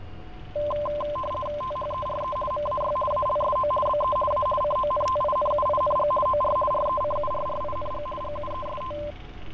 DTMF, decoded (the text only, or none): none